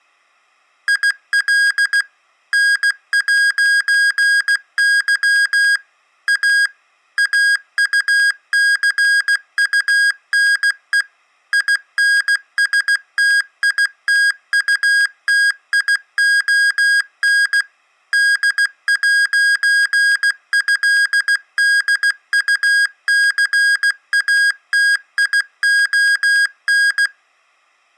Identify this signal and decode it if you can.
Morse code (with French letters), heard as electronic beeps, machine-sent, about 16 wpm, 1650 Hz. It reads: IL N'Y A AUCUNE INSTITUTION D'ÉDUCATION